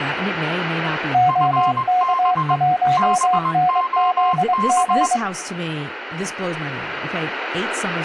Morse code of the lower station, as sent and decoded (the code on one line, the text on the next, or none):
--- -.- .---- -. --.. --.
OK1NZG